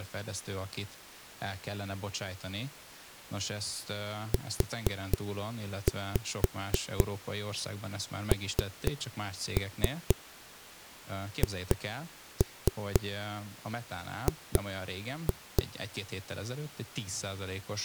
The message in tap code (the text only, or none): UNHG